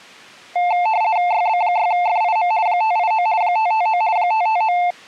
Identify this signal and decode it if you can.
RTTY (50 baud, 170 Hz shift), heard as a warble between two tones, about 790 Hz centre. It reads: YB6FIM 589 559 559